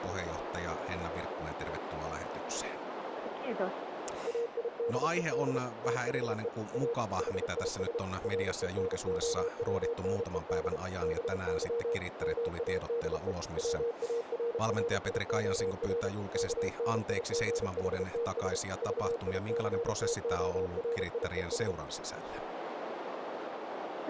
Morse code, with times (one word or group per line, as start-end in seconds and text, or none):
4.3-5.6 AIDED
5.8-6.5 THE
6.7-6.9 A
7.2-8.0 HIS
8.2-10.8 RENOWNED
11.0-12.0 BY
12.2-13.3 MADE
13.6-16.1 WARRIOR
16.3-18.6 KNIGHTS
18.8-21.7 VICTORIES